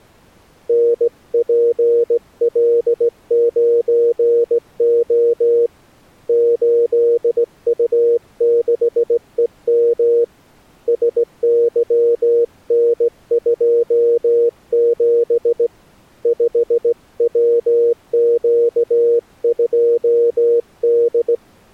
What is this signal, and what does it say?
Morse code, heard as a keyed tone, hand-sent with a straight key, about 17 wpm, 470 Hz. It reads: NPL9O 8U6EM SYN27 5WQ2D